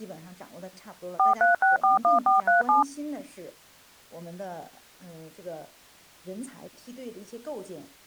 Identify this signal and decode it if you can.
DTMF, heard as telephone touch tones, dialled by machine, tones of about 140 ms. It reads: 43641437